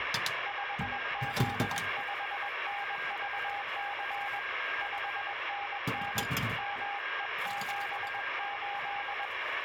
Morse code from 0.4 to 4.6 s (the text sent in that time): 5Z5NVC